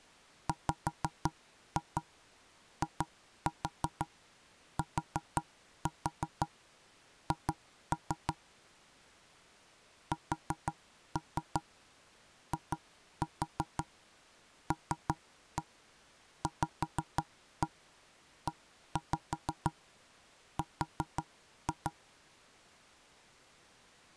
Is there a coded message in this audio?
Yes: tap code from 0.5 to 21.9 s, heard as knocks on wood, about 5 knocks a second. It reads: WITH SILVER